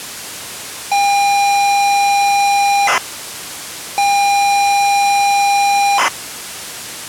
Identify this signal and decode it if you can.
ZX Spectrum tape loading, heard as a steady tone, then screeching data.